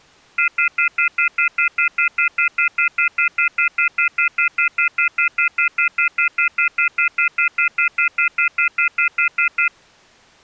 Telephone call progress tone (North American plan), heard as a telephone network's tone, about 1400, 2050, 2450, 2600 Hz, 0.1 s on and 0.1 s off. Off-hook warning tone.